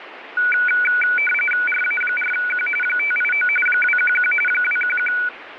RTTY (45.45 baud, 850 Hz shift), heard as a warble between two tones, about 1900 Hz centre, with radio static. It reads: RA4Q 589 211 211